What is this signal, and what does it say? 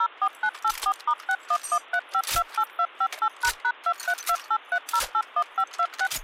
DTMF, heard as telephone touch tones, dialled by machine, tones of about 60 ms. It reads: 04984*6113528258##23283081526